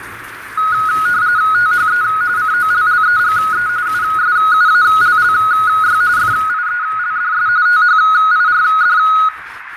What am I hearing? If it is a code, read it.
RTTY (45.45 baud, 170 Hz shift), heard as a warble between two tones, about 1360 Hz centre, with radio static, fading, a narrow filter, room echo and kitchen noise. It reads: THE COLLEGE USUALLY FIELDS THIRD